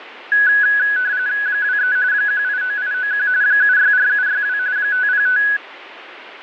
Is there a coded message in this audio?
Yes: RTTY (45.45 baud, 170 Hz shift) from 0.3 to 5.6 s, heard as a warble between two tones, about 1600 Hz centre, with radio static. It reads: 23 189891 764762 505